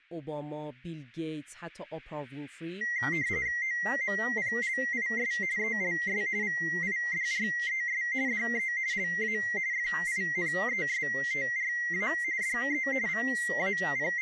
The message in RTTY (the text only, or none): OMPLIS ELS VIDRES DE LA FINESTRA DE …